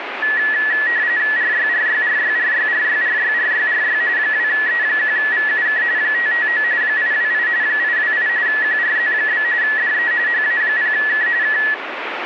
RTTY (45.45 baud, 170 Hz shift), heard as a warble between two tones, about 1800 Hz centre, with radio static. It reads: RYRYRYRYRYRYRYRY 2E1VUK 559 828 828 QRZ? DE HA0K K